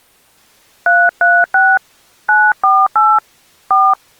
DTMF, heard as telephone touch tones, dialled by hand, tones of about 230 ms. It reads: 336 948 4